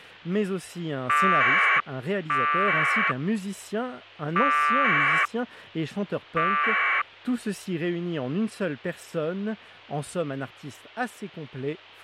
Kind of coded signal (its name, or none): packet radio (AX.25, as in APRS)